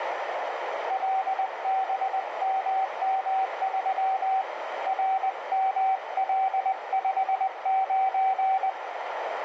Morse code, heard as a keyed tone, hand-sent with a paddle, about 20 wpm, 770 Hz, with heavy radio static and a narrow filter. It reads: LBMM3 RML59